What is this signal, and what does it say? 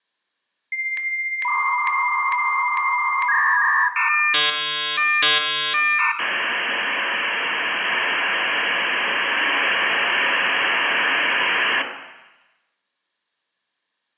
Dial-up modem handshake (V.34 or later), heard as a whistle, warbles, then hiss, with room echo.